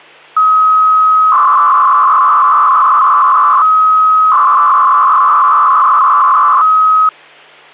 300-baud modem data (Bell 103 tones), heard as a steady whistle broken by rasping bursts, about 300 baud, 200 Hz shift, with hum.